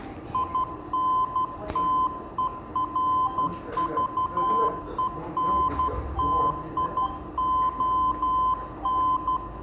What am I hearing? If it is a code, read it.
Morse code, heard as a keyed tone, hand-sent with a paddle, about 12 wpm, 1020 Hz, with room echo and the noise of a crowd indoors. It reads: INTERVENTION